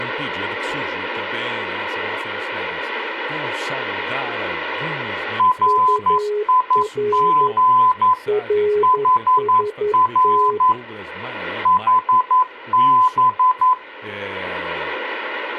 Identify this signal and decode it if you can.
Morse code, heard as two keyed tones, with speech in Portuguese. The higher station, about 11 wpm, 1010 Hz: RIG HR HB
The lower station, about 11 wpm, 420 Hz: UR RST